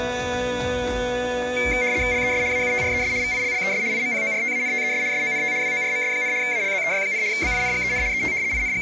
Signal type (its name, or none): RTTY